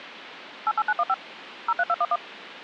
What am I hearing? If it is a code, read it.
DTMF, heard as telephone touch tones, dialled by machine, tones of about 50 ms, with phone line noise. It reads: 88915 03211